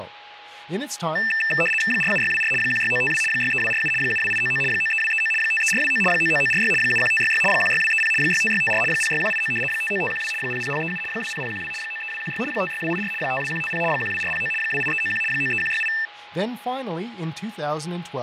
RTTY (75 baud, 850 Hz shift), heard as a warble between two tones, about 2200 Hz centre, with radio static, fading, a steady whistle near 830 Hz and speech in English. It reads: 47624 16952 63247 72899 93239 53429 99946 71566 16230 65654 06189 59512 00037 20012 93216 56284 52150 12409 28391 93168